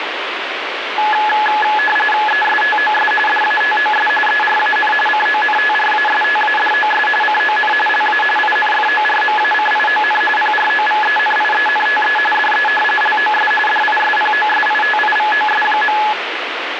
RTTY (45.45 baud, 850 Hz shift), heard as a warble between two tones, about 1280 Hz centre, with radio static. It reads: ESTOS DATOS ERAN CONTRASTADOS CON LA INFORMACION PROVENIENTE DE LOS DISPOSITIVOS.